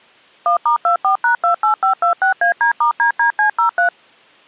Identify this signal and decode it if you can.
DTMF, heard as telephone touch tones, dialled by machine, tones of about 110 ms. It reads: 1*24#28526AD*DDC03